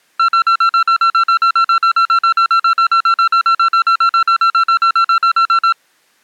Evenly repeated beeps. There is no code.